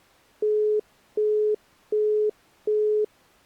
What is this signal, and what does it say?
Telephone call progress tone (as in the UK, Australia and similar networks), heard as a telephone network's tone, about 420 Hz, 0.375 s on and 0.375 s off. Busy tone.